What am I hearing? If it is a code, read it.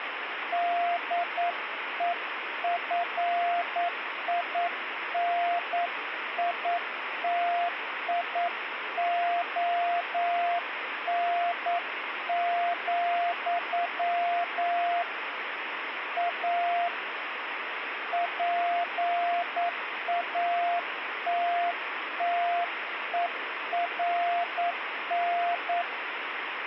Morse code, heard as a keyed tone, hand-sent with a paddle, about 9 wpm, 700 Hz, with radio static. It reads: DEFINITION, A PATTERN